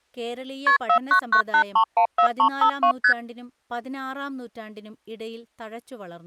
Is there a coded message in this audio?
Yes: multi-frequency trunk signalling (R1, as on North American trunks) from 0.7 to 3.1 s, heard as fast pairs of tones, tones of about 90 ms, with speech in Malayalam. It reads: KP 4998314352 ST